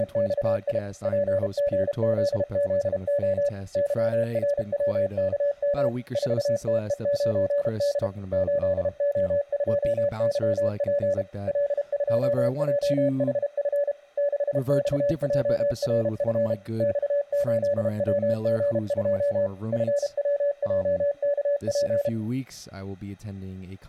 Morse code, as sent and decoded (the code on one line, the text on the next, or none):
… / .--. --. --.. --.. --- / -.-- .-. .-- -.- -- / ....- - . ----. -.. / ---.. --- ..--- -.-- .--. / .-.. ..--- .--- .... ..-. / -.... -..- .--- .-. ..-. / -..- ---.. .-- --. ..--- / ..-. .-- .--- -.- .--.
… PGZZO YRWKM 4TE9D 8O2YP L2JHF 6XJRF X8WG2 FWJKP